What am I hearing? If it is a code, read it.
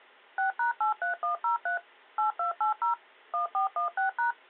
DTMF, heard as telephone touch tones, dialled by machine, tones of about 120 ms. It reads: 6#83103 8280 1416#